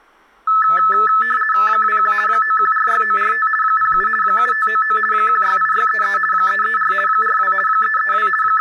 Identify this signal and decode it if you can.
RTTY (50 baud, 450 Hz shift), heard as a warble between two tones, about 1500 Hz centre, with room echo and speech in Maithili. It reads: 21 9146945 07 7599 168633 334 42 332 …